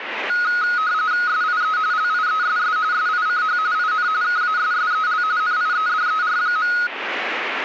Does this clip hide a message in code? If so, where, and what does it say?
Yes: RTTY (45.45 baud, 170 Hz shift) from 0.3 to 6.9 s, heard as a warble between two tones, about 1360 Hz centre, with radio static. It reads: SIE LIESS SICH IN KASSEL NIEDER.